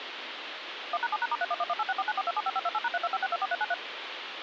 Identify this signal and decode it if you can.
DTMF, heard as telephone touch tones, dialled by machine, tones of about 40 ms, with phone line noise. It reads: 1#7#*311186494275528#325624393